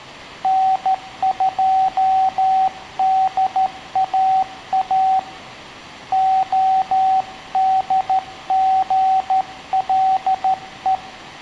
Morse code, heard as a keyed tone, hand-sent with a straight key, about 13 wpm, 760 Hz, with room echo. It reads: N2DAA ODGLE